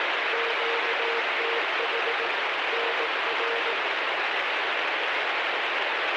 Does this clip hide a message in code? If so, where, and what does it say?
Yes: Morse code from 0.3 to 3.8 s, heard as a keyed tone, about 18 wpm, 460 Hz, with heavy radio static. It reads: QTH NR